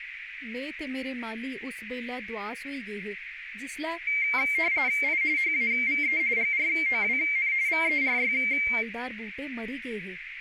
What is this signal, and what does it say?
RTTY (45.45 baud, 170 Hz shift), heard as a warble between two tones, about 2200 Hz centre, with radio static, a narrow filter and speech in Dogri. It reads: I HAVE GROWN VERY